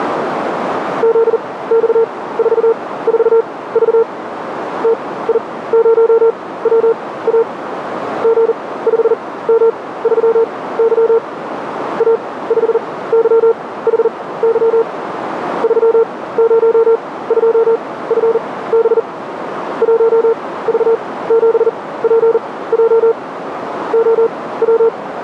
Morse code, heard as a keyed tone, machine-sent, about 40 wpm, spaced as for 19 wpm, 460 Hz, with radio static and a narrow filter. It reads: ZX44V TI0WA G5M3Y A5YHY 302FB 1V7PJ …